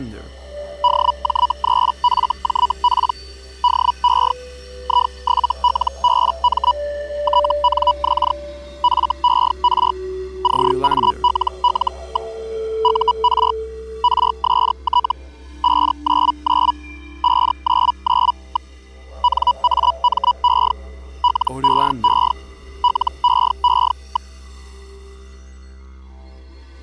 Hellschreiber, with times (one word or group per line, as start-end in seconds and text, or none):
0.8-3.1 DJ3FJP
3.6-4.3 DE
4.8-6.7 I7LBM
7.2-8.3 TNX
8.8-9.9 FER
10.4-12.3 CALL.
12.8-13.5 UR
14.0-15.1 RST
15.6-16.7 599
17.2-18.7 599.
19.2-20.7 NAME
21.2-22.3 LEE
22.8-24.3 LEE.